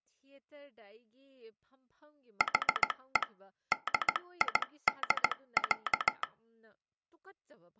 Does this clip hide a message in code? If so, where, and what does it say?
Yes: Morse code (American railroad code) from 2.3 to 6.3 s, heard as a telegraph sounder, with speech in Manipuri. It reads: HE DID,